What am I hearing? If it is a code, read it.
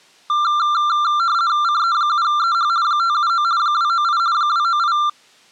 RTTY (50 baud, 170 Hz shift), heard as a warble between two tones, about 1280 Hz centre. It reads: CE7EH 579 298 298